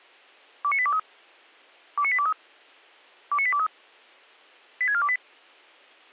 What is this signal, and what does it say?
Five-tone selective call (ZVEI), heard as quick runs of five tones, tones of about 70 ms. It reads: 29823 29823 29823 86428